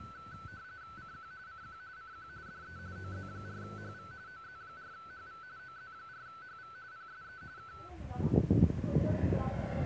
RTTY (45.45 baud, 170 Hz shift), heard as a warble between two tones, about 1420 Hz centre, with radio static and the noise of a residential street. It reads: CQ CQ CQ DE OZ4HV OZ4HV OZ4HV PSE K